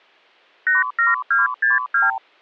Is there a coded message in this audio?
Yes: multi-frequency trunk signalling (R2, with the far end's replies) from 0.7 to 2.2 s, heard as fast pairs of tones, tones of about 160 ms. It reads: 87262